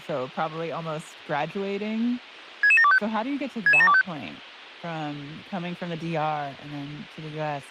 Five-tone selective call (ZVEI), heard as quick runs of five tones, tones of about 70 ms, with speech in English. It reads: 66725 66725